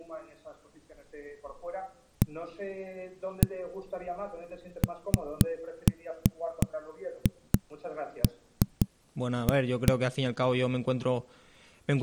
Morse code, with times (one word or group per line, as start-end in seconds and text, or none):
none